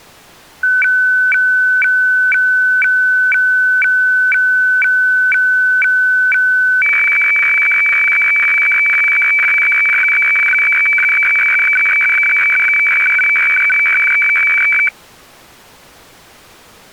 Weather fax (radiofax), 120 lines a minute, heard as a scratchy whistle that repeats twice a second.